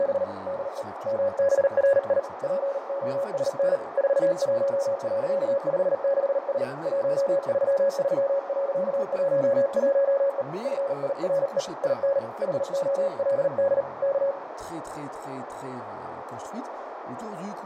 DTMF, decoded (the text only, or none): none